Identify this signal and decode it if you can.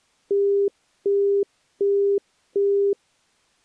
Telephone call progress tone (as in the UK, Australia and similar networks), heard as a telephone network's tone, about 400 Hz, 0.375 s on and 0.375 s off. Busy tone.